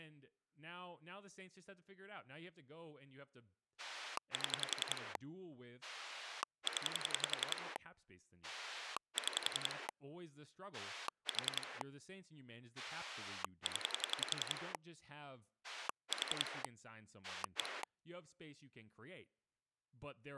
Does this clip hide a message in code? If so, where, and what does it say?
Yes: pulse dialling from 3.8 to 17.8 s, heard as a rotary dial, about 11 pulses a second, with speech in English. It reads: 7 0 6 4 0 4 1